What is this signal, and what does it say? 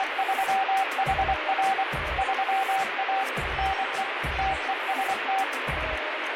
Morse code, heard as a keyed tone, machine-sent, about 24 wpm, 770 Hz, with radio static. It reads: … 3A NE TEST